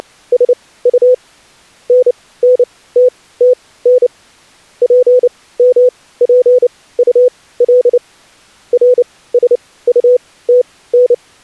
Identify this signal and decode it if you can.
Morse code, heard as a keyed tone, machine-sent, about 29 wpm, spaced as for 18 wpm, 500 Hz. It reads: … NNTTN PMPUL RSUTN